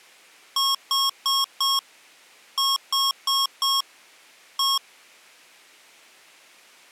Beep code, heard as beeps from a small speaker, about 1090 Hz. 4-4-1. In Phoenix BIOS tables: serial port failure.